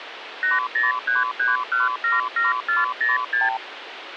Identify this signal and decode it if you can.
Multi-frequency trunk signalling (R2, with the far end's replies), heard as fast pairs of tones, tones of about 160 ms, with phone line noise. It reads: 8033177406